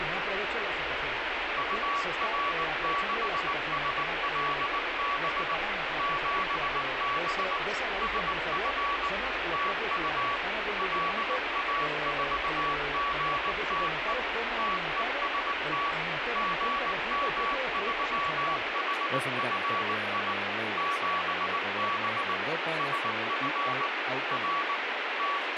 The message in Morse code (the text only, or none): UR6SLB 7B SF TU LA4GTE TEST GM3HFI 7B SF R …